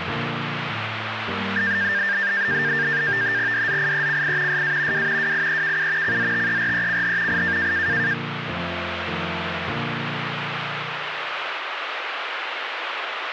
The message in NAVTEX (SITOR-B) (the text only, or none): DZIECI SA W WIEKU CZTERECH I